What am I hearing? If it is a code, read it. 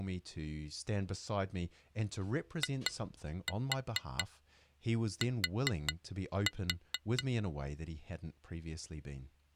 Tap code, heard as taps on glass, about 4 knocks a second, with speech in English. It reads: IT